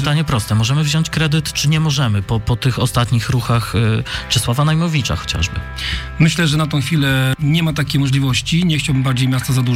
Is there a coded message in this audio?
No.